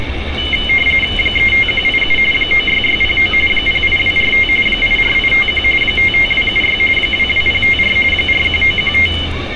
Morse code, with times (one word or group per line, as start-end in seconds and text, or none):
none